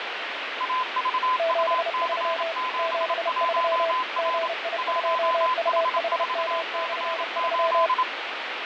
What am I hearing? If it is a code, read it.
Morse code, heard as two keyed tones, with heavy radio static and fading. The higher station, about 27 wpm, 1020 Hz: AVUC71R 1H4C8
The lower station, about 31 wpm, 650 Hz: 73 73 GI2UHM/3